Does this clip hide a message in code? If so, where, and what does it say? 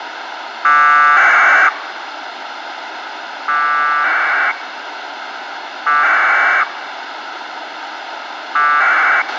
Yes: packet radio (AX.25, as in APRS), 1200 baud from 0.6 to 9.2 s, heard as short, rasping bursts, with radio hiss and a squelch burst at the end.